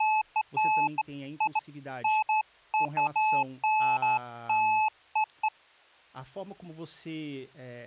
Beeps of irregular length, with speech in Portuguese. There is no code.